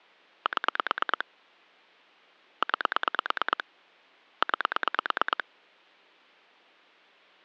Pulse dialling, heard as clicks on a phone line, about 9 pulses a second. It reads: 7 9 9